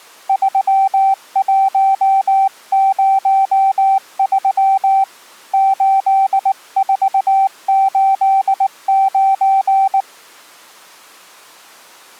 Morse code, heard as a keyed tone, hand-sent with a paddle, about 19 wpm, 780 Hz. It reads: 3103 8489